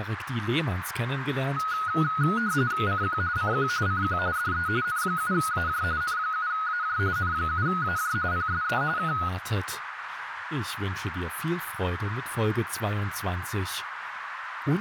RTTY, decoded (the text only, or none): CQ CQ CQ DE N7AJ N7AJ N7AJ PSE K